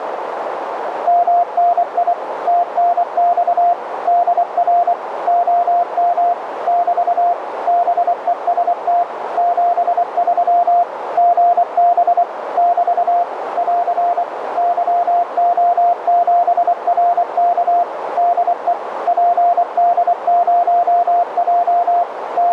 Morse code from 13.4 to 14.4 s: <AR>

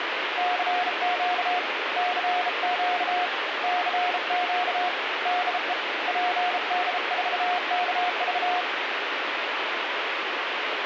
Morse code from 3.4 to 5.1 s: CQ

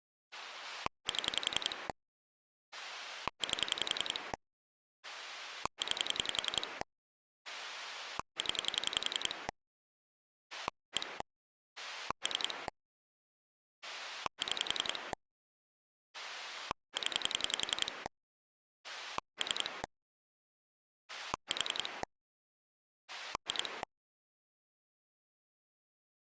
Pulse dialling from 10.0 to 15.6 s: 1 3 6

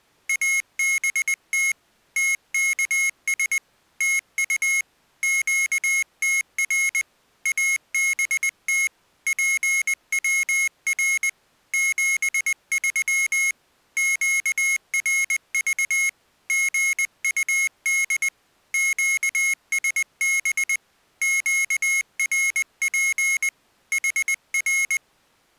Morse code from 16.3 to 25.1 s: GUD QSB QRP HR

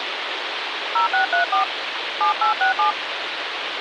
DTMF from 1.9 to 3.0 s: 7867

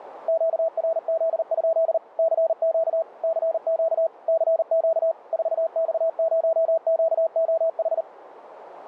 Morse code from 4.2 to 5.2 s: CQ

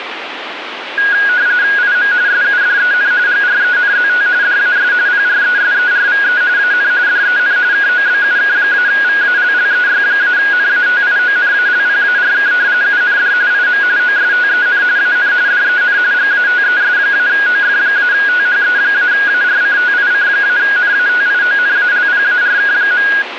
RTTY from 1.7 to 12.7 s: IM SUDEN GRENZT DAS PRESERVE AN DEN KOBUK-VALLEY-NATIONALPARK

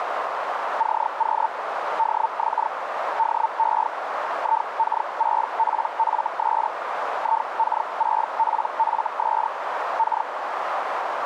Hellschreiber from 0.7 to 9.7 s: CQ DX DE IK6PFS IK6PFS

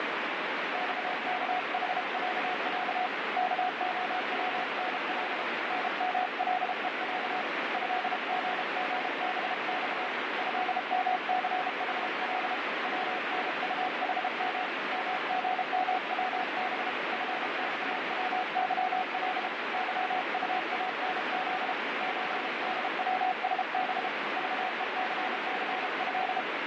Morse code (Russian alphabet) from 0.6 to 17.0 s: ЬКХЯЯ КОВНЛ НМЛЕЯ ЭГГБЬ ЭМЦХЛ ВНУХМ МГМВБ

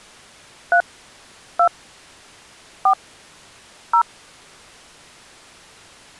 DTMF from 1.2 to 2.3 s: 2

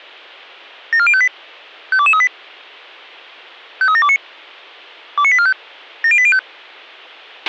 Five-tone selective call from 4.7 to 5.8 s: 29845

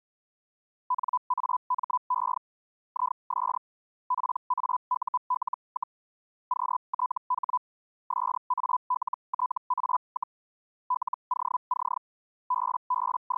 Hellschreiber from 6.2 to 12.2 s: QTH SALTA, LOC

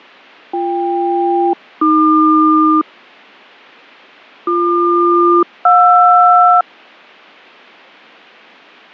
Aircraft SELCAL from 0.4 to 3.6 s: BK-AQ

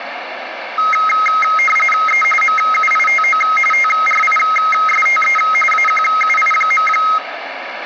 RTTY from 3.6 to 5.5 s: TRISTE

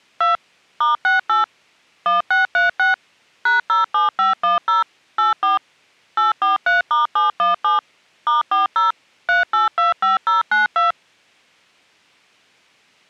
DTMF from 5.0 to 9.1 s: 84 843*717 *40

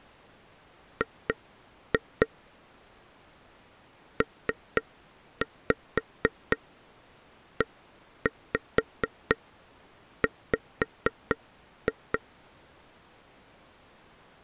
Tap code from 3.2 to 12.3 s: PEW

